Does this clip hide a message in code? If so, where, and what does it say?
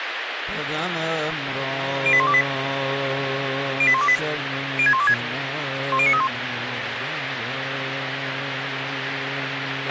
Yes: five-tone selective call (ZVEI) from 2.1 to 6.3 s, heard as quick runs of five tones, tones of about 70 ms, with radio hiss and a squelch burst at the end. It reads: 08128 08128 06126 10931